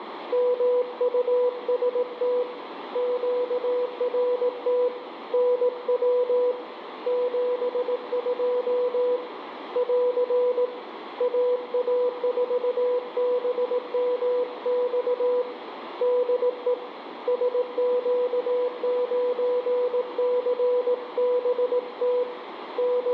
Morse code, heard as a keyed tone, hand-sent with a paddle, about 18 wpm, 490 Hz, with radio static and room echo. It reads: MUST QRT NW 72 <AR> AA4BMX DE SQ9CBT …